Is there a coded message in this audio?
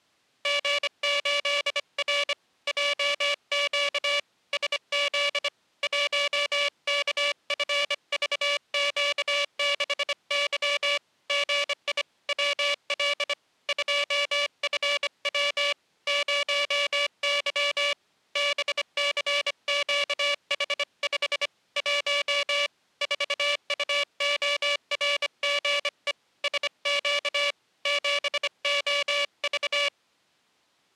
Yes: Morse code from 0.4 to 29.9 s, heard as a buzzer, hand-sent with a bug key, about 25 wpm. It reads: G8R JQ SZ 1KFVQ6Y GI WL 2FW 0Y BCQH5 1 4UORGE SQ 7OV